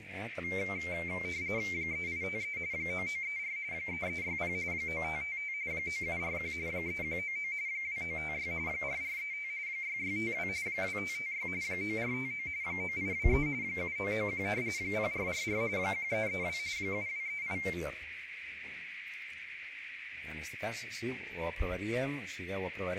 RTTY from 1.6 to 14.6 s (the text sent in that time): 3853 9934 3360 9555 9741 3199 2956 4435 6652 2556 9459 9823 7991